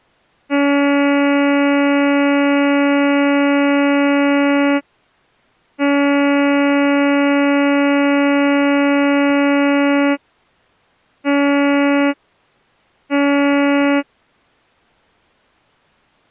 Ship horn signal, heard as a ship's horn, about 280 Hz. 2 long, 2 short. At sea: I intend to overtake on your port side.